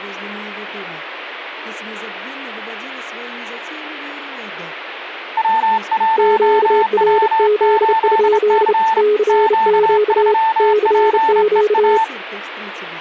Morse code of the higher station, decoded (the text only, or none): W1W8C Q3PEA